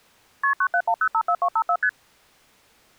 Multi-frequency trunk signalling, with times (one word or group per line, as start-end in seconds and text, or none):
0.4-0.5 KP
0.6-1.8 971054254
1.8-1.9 ST